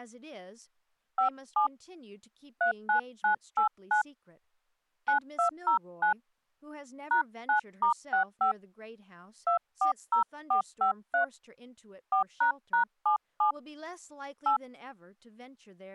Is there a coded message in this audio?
Yes: DTMF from 1.2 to 14.6 s, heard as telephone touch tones, dialled by hand, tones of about 110 ms, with speech in English. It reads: 57 39989 9209 #9*65 240453 4##77 8